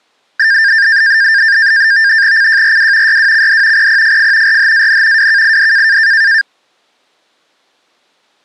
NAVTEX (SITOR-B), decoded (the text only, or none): CJRW YWCD PPFF RHAN WKID